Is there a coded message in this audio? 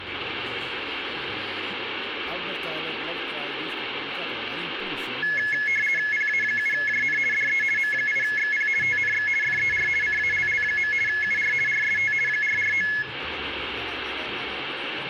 Yes: RTTY (50 baud, 450 Hz shift) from 5.2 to 13.0 s, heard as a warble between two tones, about 1950 Hz centre, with radio static. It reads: PA7JN DE M8XP TNX FER CALL. UR RST 449